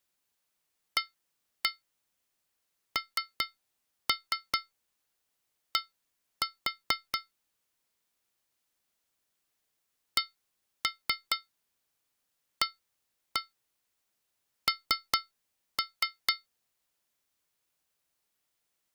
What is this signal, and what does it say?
Tap code, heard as taps on glass, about 4 knocks a second. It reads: AND CAN